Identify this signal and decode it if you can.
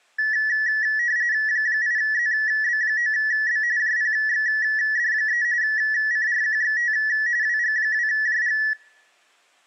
RTTY (45.45 baud, 170 Hz shift), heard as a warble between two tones, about 1800 Hz centre, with room echo. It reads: 8ZB9B JPXD3 CRQXT WG2JG